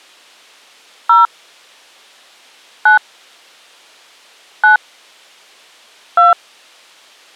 DTMF, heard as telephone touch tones, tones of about 110 ms. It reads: 0 9 9 2